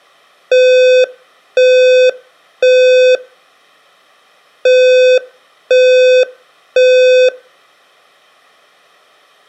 Alarm pattern, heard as an alarm's beeps, played twice, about 510 Hz, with room echo. Temporal three. Smoke or fire, evacuate.